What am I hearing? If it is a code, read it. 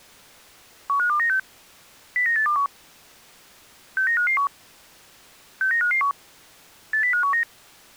Five-tone selective call (CCIR), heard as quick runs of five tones, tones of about 100 ms. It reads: 15296 09821 69551 69551 80519